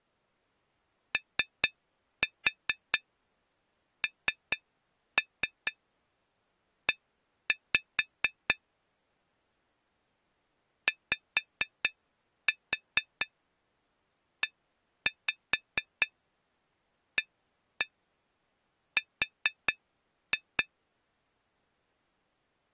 Tap code, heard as taps on glass, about 4 knocks a second. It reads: ONE YEAR